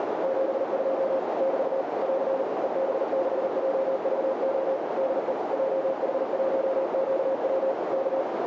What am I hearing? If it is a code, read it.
Morse code, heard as a keyed tone, machine-sent, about 39 wpm, 540 Hz, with heavy radio static and a narrow filter. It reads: 72 <BT> <AR> EB6JVO DE JH1QW K